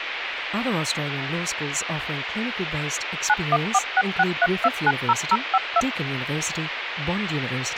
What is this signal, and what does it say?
DTMF, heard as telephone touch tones, dialled by machine, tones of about 50 ms, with phone line noise and speech in English. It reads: 914663290052